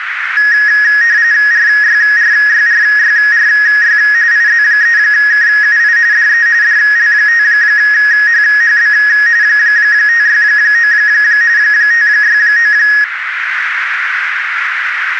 RTTY (45.45 baud, 170 Hz shift), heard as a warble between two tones, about 1800 Hz centre, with radio static and a narrow filter. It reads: RYRYRYRY IZ3KUI DE DL5HHB 569 569